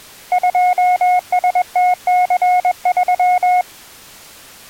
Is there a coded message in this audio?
Yes: Morse code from 0.3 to 3.7 s, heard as a keyed tone, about 21 wpm, 720 Hz. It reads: 2STC3